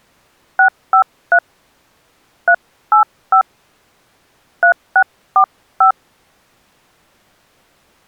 DTMF, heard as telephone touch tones, dialled by hand, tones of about 90 ms. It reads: 653 385 3645